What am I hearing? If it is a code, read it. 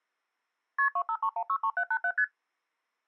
Multi-frequency trunk signalling (R1, as on North American trunks), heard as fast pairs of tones, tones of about 70 ms. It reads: KP 253163787 ST